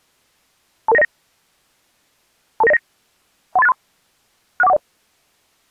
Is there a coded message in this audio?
Yes: five-tone selective call (EIA) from 0.9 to 4.8 s, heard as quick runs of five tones, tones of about 30 ms. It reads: 22909 22909 13863 61410